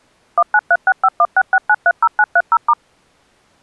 DTMF, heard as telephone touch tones, dialled by machine, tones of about 50 ms. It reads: 19365166930930*